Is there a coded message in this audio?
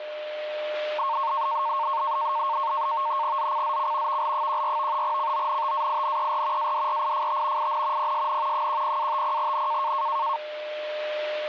Yes: NAVTEX (SITOR-B), 100 baud, 170 Hz shift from 1.0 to 10.4 s, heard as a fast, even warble, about 1000 Hz centre, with a steady whistle near 600 Hz. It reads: ZCZC VL14 CONTAINER ADRIFT IN PSN 10-50N